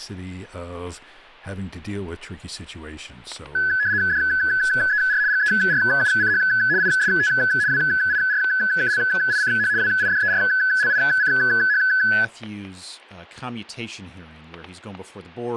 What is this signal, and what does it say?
RTTY (75 baud, 170 Hz shift), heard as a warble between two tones, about 1600 Hz centre, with static crashes and speech in English. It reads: DER GERUCH IST WIRKLICH WIDERLICH